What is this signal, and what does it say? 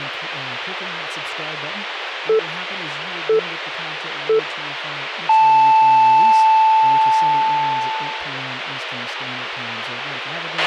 Radio time signal (three low pips and a long one an octave up, as on NHK), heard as pips, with radio hiss, a squelch burst at the end and speech in English.